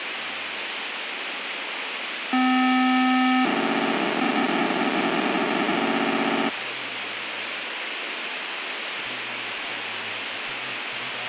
POCSAG pager data (512 baud), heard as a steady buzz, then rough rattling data, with radio hiss and speech in English.